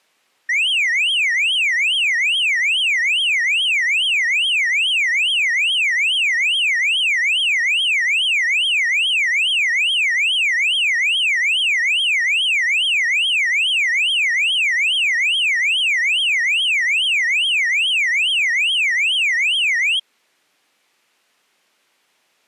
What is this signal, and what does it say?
A tone that sweeps in pitch again and again. There is no code.